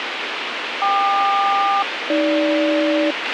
Aircraft SELCAL, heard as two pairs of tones, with radio hiss and a squelch burst at the end. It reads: KQ-AG